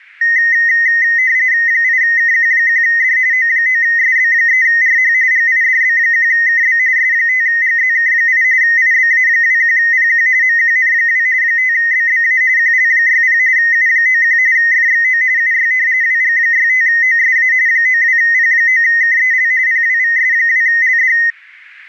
RTTY (45.45 baud, 170 Hz shift), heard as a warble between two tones, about 1950 Hz centre. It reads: 8KQ1D O9SB3RH GIDB1KB S5GZK8 IBA21PQ MQN2 5BBA QL60 U91 FXO UY WG65OSA 92P9KEL PWVS2LD